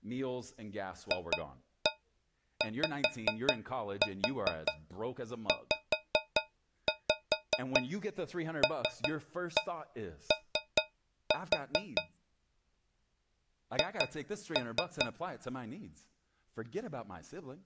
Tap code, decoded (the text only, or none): FYZLO H